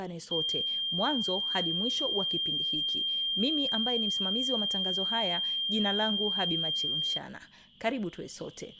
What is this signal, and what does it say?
A steady tone, with speech in Swahili. There is no code.